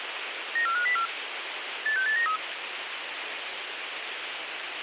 Five-tone selective call (CCIR), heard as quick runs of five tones, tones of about 100 ms, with radio hiss and a squelch burst at the end. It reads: 94504 86893